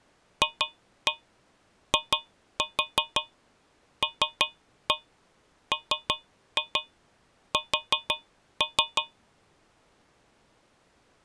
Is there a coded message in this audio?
Yes: tap code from 0.4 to 9.2 s, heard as taps on a metal pipe, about 5 knocks a second. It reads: FILMS